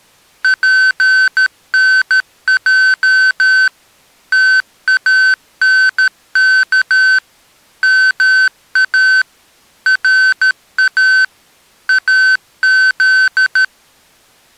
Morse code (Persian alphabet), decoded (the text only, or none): پنج تانک ما را از